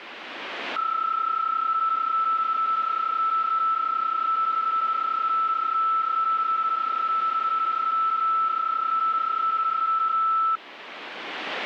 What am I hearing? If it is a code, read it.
PSK31 (31.25 baud), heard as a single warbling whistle, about 1320 Hz, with radio static.